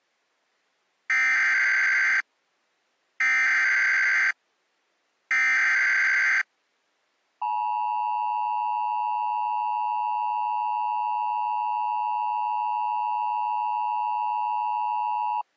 Emergency Alert System (SAME) tones (header bursts, then the 853 and 960 Hz attention tone), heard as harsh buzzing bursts, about 520.83 baud.